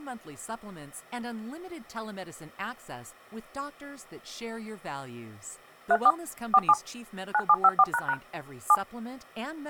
DTMF, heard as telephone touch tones, dialled by machine, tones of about 50 ms, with speech in English. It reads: 34 47 9754## 7